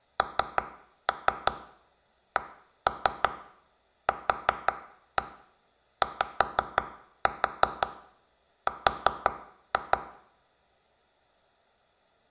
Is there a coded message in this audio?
Yes: tap code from 0.2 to 10.0 s, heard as taps on a table, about 5 knocks a second, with room echo. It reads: NCQYR